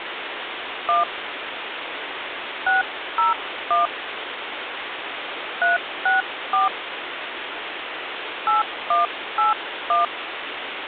DTMF, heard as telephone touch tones, dialled by hand, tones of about 150 ms, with phone line noise. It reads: 1 601 364 8181